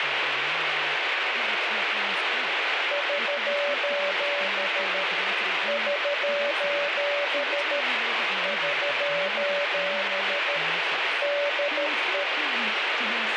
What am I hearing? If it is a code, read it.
Morse code, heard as a keyed tone, machine-sent, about 13 wpm, 580 Hz, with heavy radio static and speech in English. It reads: <SOS> <SOS> <SOS> DE